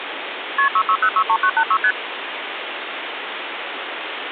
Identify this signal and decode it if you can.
Multi-frequency trunk signalling (R1, as on North American trunks), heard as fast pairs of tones, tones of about 70 ms, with phone line noise. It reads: KP 66063986 ST